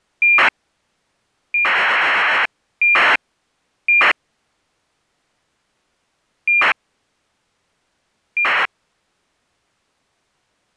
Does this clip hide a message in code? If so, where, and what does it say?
Yes: ACARS aircraft data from 0.2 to 8.7 s, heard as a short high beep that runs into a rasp, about 2400 baud.